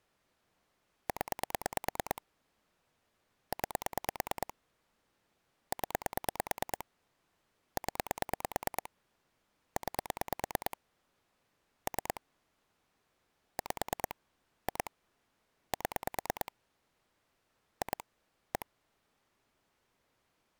Pulse dialling, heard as clicks on a phone line, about 9 pulses a second. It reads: 0 9 0 0 9 3 5 2 7 2 1